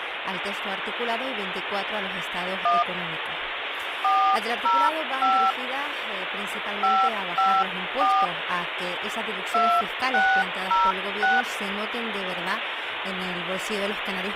DTMF, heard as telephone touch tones, dialled by hand, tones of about 250 ms, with phone line noise. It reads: 1 405 554 2606